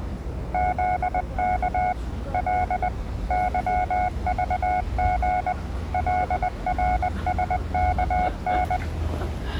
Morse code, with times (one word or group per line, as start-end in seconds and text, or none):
0.5-1.9 ZK
2.3-2.9 L
3.3-5.5 YVG
5.9-8.8 LRSKN